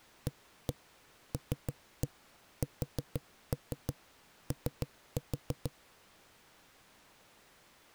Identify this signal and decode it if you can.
Tap code, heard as knocks on a wall, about 6 knocks a second. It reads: ALSO